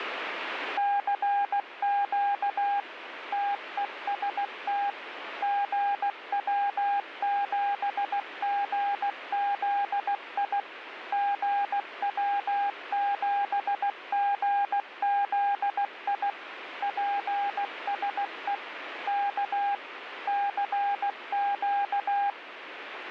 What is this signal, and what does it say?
Morse code, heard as a keyed tone, machine-sent, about 16 wpm, 810 Hz, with radio static. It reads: CQ TEST GW7GZI GW7GZI PSE K CQ